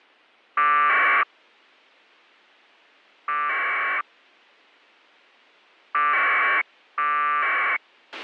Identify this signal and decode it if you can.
Packet radio (AX.25, as in APRS), 1200 baud, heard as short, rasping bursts, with a squelch burst at the end.